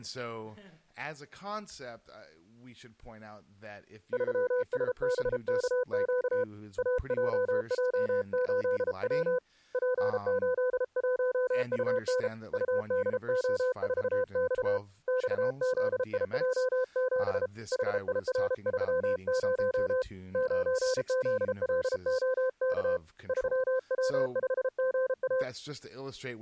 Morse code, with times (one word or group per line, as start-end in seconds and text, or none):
4.1-6.4 3SBKQ
6.8-9.4 AJJ8W
9.7-12.3 P81UN
12.5-14.8 UDO4X
15.1-17.5 XZIJ7
17.7-20.0 HIR30
20.3-23.0 9ZLOK
23.3-25.4 3W5GA